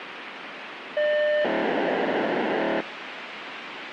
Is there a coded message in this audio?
Yes: POCSAG pager data (1200 baud) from 1.0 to 2.8 s, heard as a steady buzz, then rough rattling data, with radio hiss.